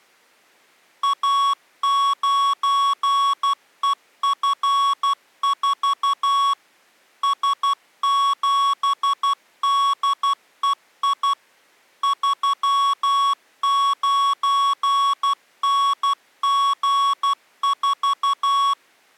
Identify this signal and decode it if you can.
Morse code, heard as electronic beeps, machine-sent, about 12 wpm, 1120 Hz. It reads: A9EF4 S7DEI 39NG4